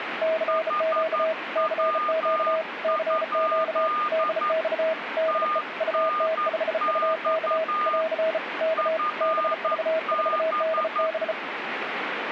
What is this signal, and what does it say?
Morse code, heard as two keyed tones, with radio static. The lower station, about 34 wpm, 640 Hz: CQ CQ CQ DX DE UT5UK <AR> K BV4DB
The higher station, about 11 wpm, 1220 Hz: HW? TNX FB